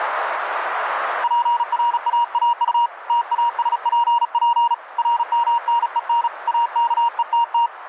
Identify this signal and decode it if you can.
Morse code, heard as a keyed tone, hand-sent with a paddle, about 36 wpm, 940 Hz, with radio static and a narrow filter. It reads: PRAAU TASPP RMNEN AKETT